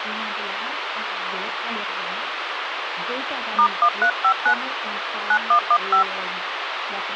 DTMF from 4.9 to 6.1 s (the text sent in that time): 9115